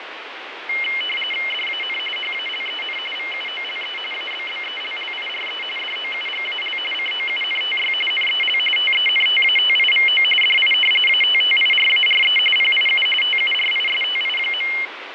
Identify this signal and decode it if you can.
RTTY (45.45 baud, 850 Hz shift), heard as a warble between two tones, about 2550 Hz centre, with radio static and fading. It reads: DAN HALEN VUOLE ABBELLIRE DOUGAL COUNTY NEL TENTATIVO DI ATTIRARE PIU TURISTI.